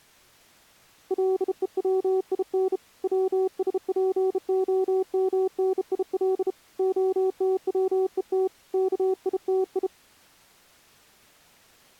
Morse code (Russian alphabet), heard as a keyed tone, hand-sent with a bug key, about 32 wpm, 380 Hz. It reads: ЛЕВИН ВСПОМНИЛ ОТВЕТ КИТИ